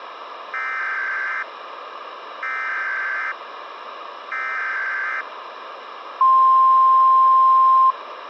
Emergency Alert System (SAME) tones (header bursts, then the 1050 Hz attention tone), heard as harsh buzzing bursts, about 520.83 baud, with radio hiss.